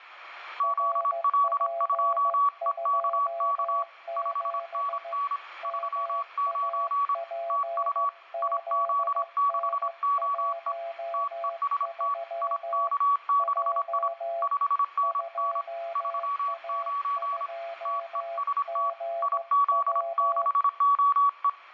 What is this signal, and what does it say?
Morse code, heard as two keyed tones, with radio static. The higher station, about 26 wpm, 1130 Hz: ZL2EKK 5NN 39 TU IZ6OE TEST IK6I 5NN 39 TEST IZ6OE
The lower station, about 15 wpm, 680 Hz: RP27 MAPZN13 J 2A2GW